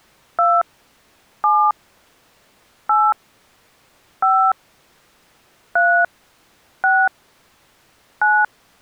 DTMF, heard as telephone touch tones, dialled by hand, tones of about 220 ms. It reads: 2 7 8 5 3 6 9